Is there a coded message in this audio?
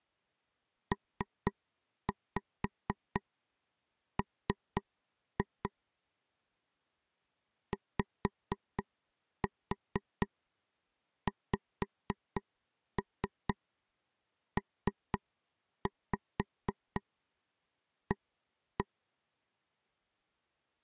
Yes: tap code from 0.9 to 18.9 s, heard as taps on a table, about 4 knocks a second. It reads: PM YXPA